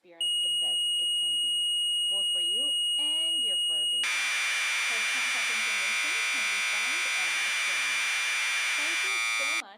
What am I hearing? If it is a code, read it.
Commodore tape loading (standard loader), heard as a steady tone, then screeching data, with speech in English.